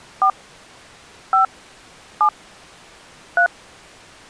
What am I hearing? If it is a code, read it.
DTMF, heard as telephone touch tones, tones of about 110 ms. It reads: 4 5 7 3